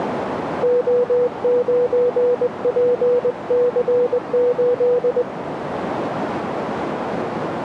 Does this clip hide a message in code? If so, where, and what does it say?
Yes: Morse code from 0.6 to 5.3 s, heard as a keyed tone, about 20 wpm, 490 Hz, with radio static and a narrow filter. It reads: O9PC8